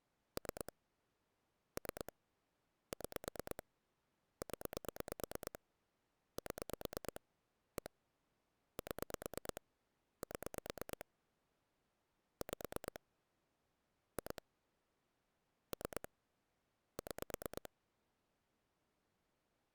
Pulse dialling, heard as clicks on a phone line, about 9 pulses a second. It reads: 3 3 6 0 7 1 7 7 5 2 3 6